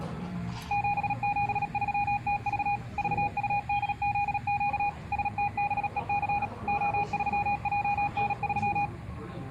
Morse code, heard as a keyed tone, machine-sent, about 37 wpm, 820 Hz, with the noise of a cafe. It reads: 773TV VUDZQ STBEC O3JN3